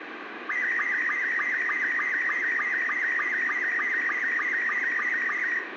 SSTV (slow-scan television), Robot 72, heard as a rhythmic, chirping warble, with radio static and room echo.